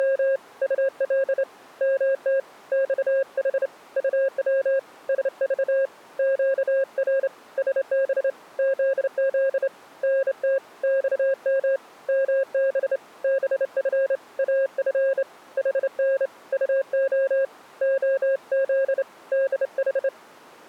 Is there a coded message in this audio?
Yes: Morse code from 0.0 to 20.1 s, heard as a keyed tone, hand-sent with a straight key, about 28 wpm, 540 Hz. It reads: … UL MT XH UW SV QR SB ZZ NT XM MB BF AF HN UO OZ DH